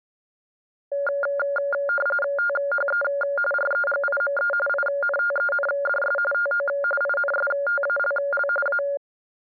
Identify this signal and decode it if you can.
RTTY (45.45 baud, 850 Hz shift), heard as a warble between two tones, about 990 Hz centre. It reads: THE REGIME INTENDS TO INSTALL A